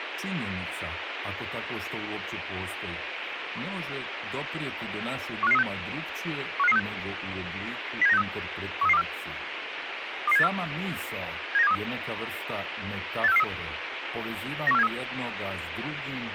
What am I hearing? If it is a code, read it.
Five-tone selective call (EEA), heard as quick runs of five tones, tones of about 40 ms, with radio hiss and speech in Croatian. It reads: 15536 15536 07963 13324 22784 79723 86443 91473